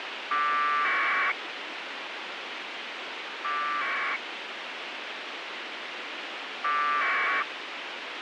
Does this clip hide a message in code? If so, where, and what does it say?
Yes: packet radio (AX.25, as in APRS), 1200 baud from 0.3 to 7.4 s, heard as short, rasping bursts, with radio hiss.